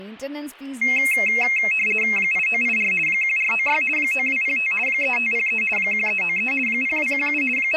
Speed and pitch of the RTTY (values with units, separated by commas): 50 baud, 450 Hz shift, 2350 Hz centre